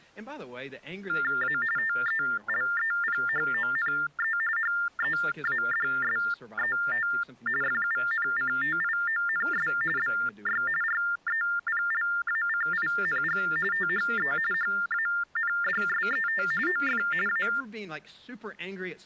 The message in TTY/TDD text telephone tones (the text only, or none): A TELEPHONE HEADSET FUNCTIONS BY REPLACING THE HANDSET OF A